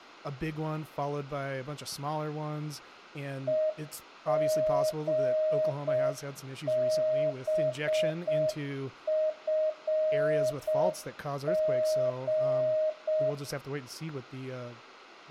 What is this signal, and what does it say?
Morse code, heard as a keyed tone, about 6 wpm, 620 Hz, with room echo and speech in English. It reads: EGBFG